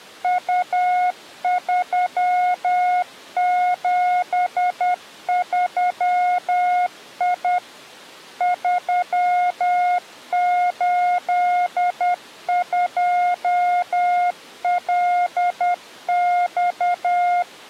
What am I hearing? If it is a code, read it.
Morse code, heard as a keyed tone, machine-sent, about 10 wpm, 720 Hz. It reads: U373I 382LX